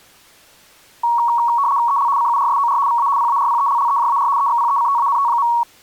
RTTY (75 baud, 170 Hz shift), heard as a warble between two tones, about 1030 Hz centre. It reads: EL CURSOR VA PARPELLEJAR EXPECTANT.